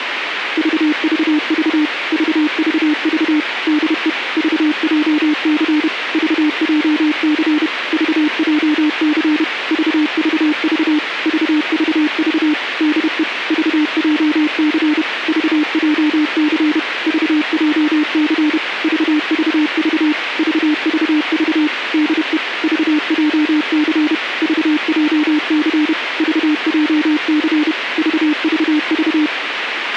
Morse code, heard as a keyed tone, machine-sent, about 31 wpm, 300 Hz, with radio hiss and a squelch burst at the end. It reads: VVV VVV DE VJC VJC VJC VVV VVV DE VJC VJC VJC VVV VVV DE VJC VJC VJC VVV